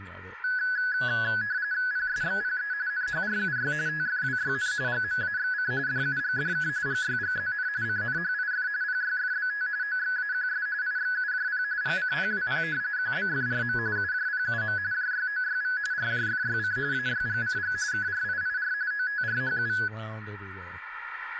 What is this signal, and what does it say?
RTTY (45.45 baud, 170 Hz shift), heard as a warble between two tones, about 1600 Hz centre, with radio static, room echo and speech in English. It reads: PSXPE NHRUY TFWYN GMAXC DUGDK GYGZN CNHIF PYFBT OXAQS IXUJP GCPWP QBFRM UJPUM JYOYV RJFYC AYGCG KRIIR OTRHU